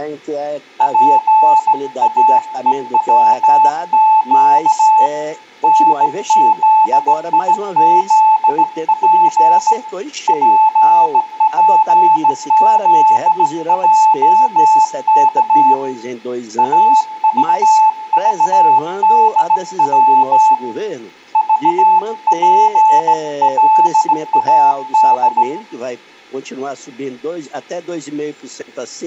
Morse code, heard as a keyed tone, hand-sent with a straight key, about 17 wpm, 870 Hz, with room echo. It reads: PAEWQ NZIZP PPZJK AVVDW VPLAD